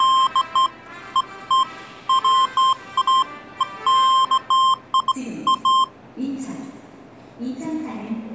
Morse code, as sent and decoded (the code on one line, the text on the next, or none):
none